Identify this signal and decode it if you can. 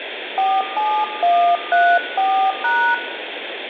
DTMF, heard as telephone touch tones, dialled by hand, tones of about 280 ms, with phone line noise and room echo. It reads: 47134#